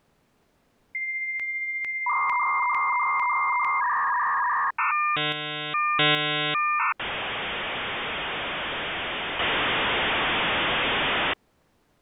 Dial-up modem handshake (V.34 or later), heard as a whistle, warbles, then hiss.